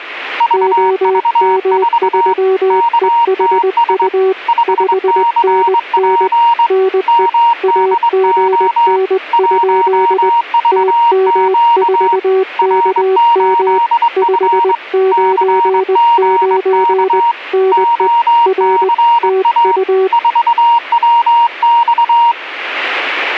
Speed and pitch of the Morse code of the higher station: 22 wpm, 940 Hz

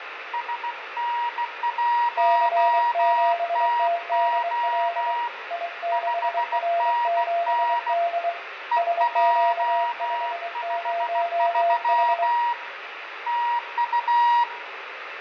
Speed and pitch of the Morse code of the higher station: 16 wpm, 950 Hz

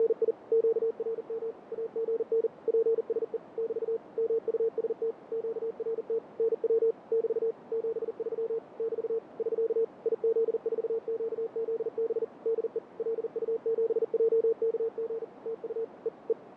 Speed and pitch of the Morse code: 40 wpm, 450 Hz

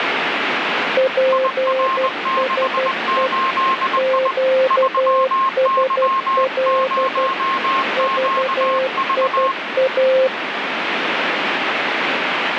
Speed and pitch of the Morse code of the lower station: 12 wpm, 520 Hz

